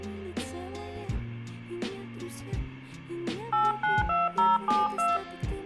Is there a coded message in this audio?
Yes: DTMF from 3.5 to 5.2 s, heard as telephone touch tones, dialled by hand, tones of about 190 ms, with hum. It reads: 892072